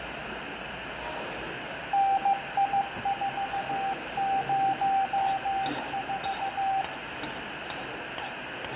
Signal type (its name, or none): Morse code